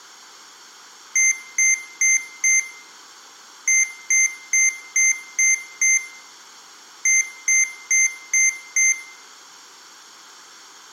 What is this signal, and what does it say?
Beep code, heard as beeps from a small speaker, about 2100 Hz, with room echo. 4-6-5.